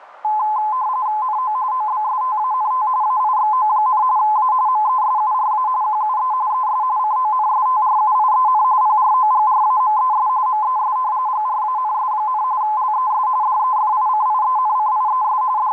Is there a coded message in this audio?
Yes: RTTY (45.45 baud, 170 Hz shift) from 0.2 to 15.7 s, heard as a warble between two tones, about 940 Hz centre, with radio static. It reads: NO OBSTANT AIXO, A MESURA QUE ES CONSTRUIEN PROGRAMES MES GRANS, LES DEFICIENCIES …